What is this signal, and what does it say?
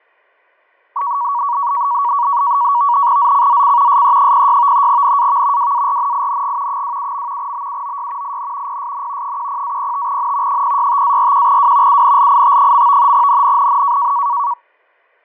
NAVTEX (SITOR-B), 100 baud, 170 Hz shift, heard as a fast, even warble, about 1040 Hz centre, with fading and static crashes. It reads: ZCZC SE06 NAV WARNING 27. BUOY IN PSN 10-05N 065-41W UNLIT. NNNN